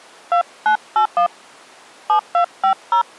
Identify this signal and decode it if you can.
DTMF, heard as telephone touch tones, dialled by hand, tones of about 100 ms. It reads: 2981 7250